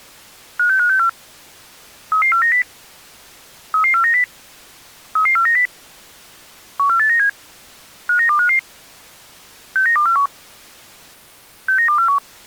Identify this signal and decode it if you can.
Five-tone selective call (CCIR), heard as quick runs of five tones, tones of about 100 ms. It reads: 56564 33490 33490 33490 14897 59255 69241 69241